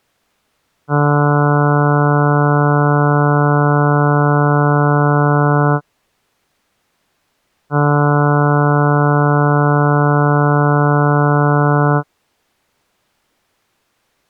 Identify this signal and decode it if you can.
Ship horn signal, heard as a ship's horn, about 150 Hz. 2 long. At sea: a vessel under power that has stopped in fog.